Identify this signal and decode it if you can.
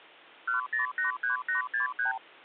Multi-frequency trunk signalling (R2, with the far end's replies), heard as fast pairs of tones, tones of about 130 ms. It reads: 1083863